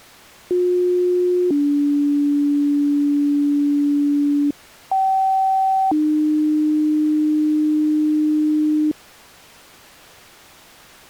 Two-tone page, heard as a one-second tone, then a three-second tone, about 360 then 290 Hz, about 770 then 300 Hz.